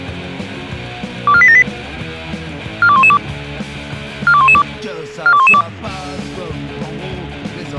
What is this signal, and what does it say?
Five-tone selective call (ZVEI), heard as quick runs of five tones, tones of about 70 ms. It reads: 24878 42112 42112 42112